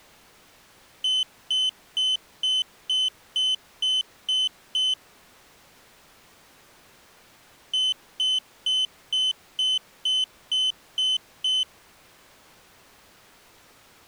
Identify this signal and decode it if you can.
Beep code, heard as a piezo beeper, played twice, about 3050 Hz. 9 short. In AMI BIOS tables: ROM checksum failure.